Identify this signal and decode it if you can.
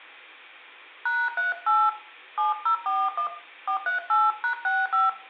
DTMF, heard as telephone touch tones, dialled by hand, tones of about 160 ms, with room echo. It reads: #38 7041 438#65